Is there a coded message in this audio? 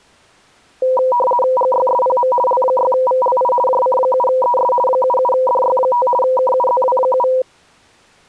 Yes: RTTY (50 baud, 450 Hz shift) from 0.8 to 7.4 s, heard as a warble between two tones, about 740 Hz centre. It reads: GYSPM L6VLI JC7ES 77DY5 KUZW7